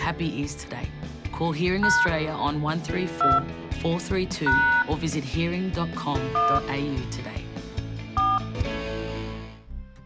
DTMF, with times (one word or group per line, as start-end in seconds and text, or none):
1.8-2.1 #
3.2-3.4 2
4.5-4.8 #
6.4-6.6 1
8.2-8.4 4